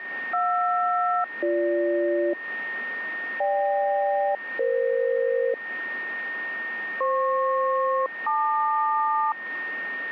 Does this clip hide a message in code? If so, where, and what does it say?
Yes: aircraft SELCAL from 0.3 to 9.3 s, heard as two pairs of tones, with a steady whistle near 1840 Hz. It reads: JR-BG GK-EF FP-LQ